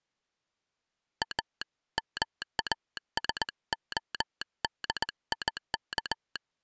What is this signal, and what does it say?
Morse code, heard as a telegraph sounder, hand-sent with a straight key, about 18 wpm. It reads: A MASODIK